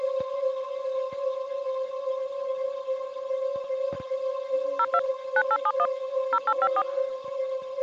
DTMF, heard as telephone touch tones, dialled by machine, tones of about 60 ms. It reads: 02 9871 0854